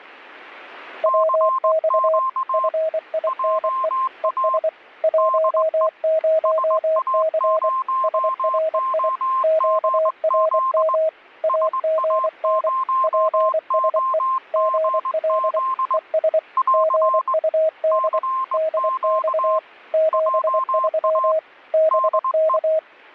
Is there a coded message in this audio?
Yes: Morse code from 1.0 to 22.8 s, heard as two keyed tones. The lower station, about 24 wpm, 640 Hz: WX FINE ES 10C SRI QRM AGN PSE GL ES GUD DX 73 BK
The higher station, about 20 wpm, 1050 Hz: CQ JA DE SA0OGZ SA0OGZ <AR> CQ JA DE